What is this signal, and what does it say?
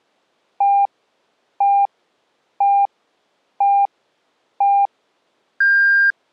Radio time signal (five pips and a higher one, as on Chinese radio), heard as pips.